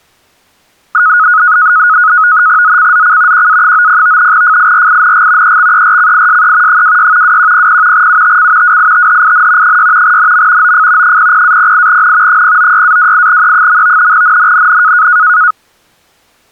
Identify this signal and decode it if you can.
NAVTEX (SITOR-B), 100 baud, 170 Hz shift, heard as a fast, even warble, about 1360 Hz centre. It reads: ZCZC QA90 FIRING EXERCISE 26 2100 UTC WITHIN 6 NM OF 00-08N 096-28E. NNNN